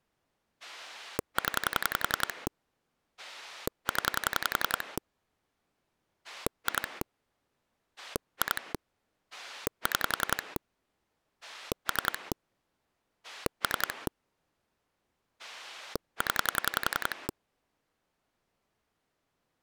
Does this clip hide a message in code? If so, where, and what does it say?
Yes: pulse dialling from 0.6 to 17.3 s, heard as a rotary dial, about 11 pulses a second. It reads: 0 0 2 2 6 3 3 0